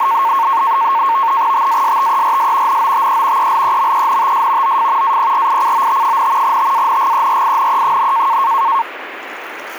NAVTEX (SITOR-B), 100 baud, 170 Hz shift, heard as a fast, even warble, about 1000 Hz centre, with radio static and the noise of a restroom. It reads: TASTERS NOTE ELEMENTS OF APRICOT, TANGERINE,